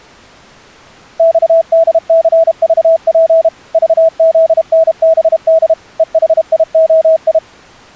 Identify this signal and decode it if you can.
Morse code, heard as a keyed tone, machine-sent, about 32 wpm, 650 Hz. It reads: XDCVP VZNBD EHIOI